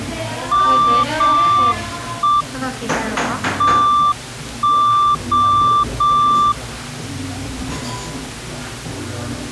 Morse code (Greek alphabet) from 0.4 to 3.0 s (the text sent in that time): ΜΕ